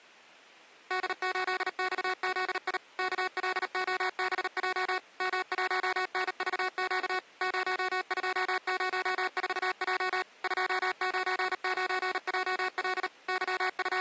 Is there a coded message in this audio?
Yes: Morse code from 0.8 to 14.0 s, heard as electronic beeps, machine-sent, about 38 wpm, 370 Hz. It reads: D8XZI KLOBJ M1NVQ 0204J 299JL …